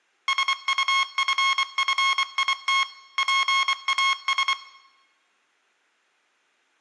Morse code, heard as electronic beeps, machine-sent, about 24 wpm, 1080 Hz, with room echo. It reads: SUFFIT PAS